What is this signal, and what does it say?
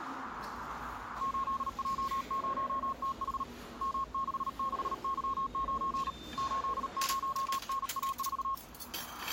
Morse code, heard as a keyed tone, hand-sent with a paddle, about 38 wpm, 1080 Hz, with the noise of a restaurant. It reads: 8J0TH M66Y9 80NA4